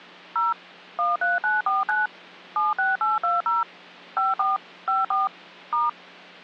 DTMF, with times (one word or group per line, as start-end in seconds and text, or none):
0.4-0.5 0
1.0-2.1 13949
2.6-3.6 76820
4.2-4.6 54
4.9-5.3 54
5.7-5.9 *